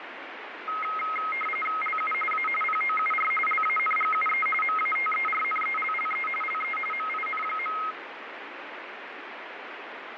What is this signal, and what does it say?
RTTY (45.45 baud, 850 Hz shift), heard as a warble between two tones, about 1700 Hz centre, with radio static. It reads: LU A POUR LANGUE MATERNELLE LE MIN.